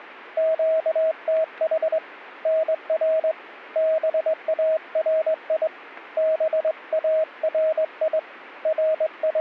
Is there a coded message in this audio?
Yes: Morse code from 0.3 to 9.4 s, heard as a keyed tone, hand-sent with a straight key, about 21 wpm, 640 Hz. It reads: QTH NR BARI BARI …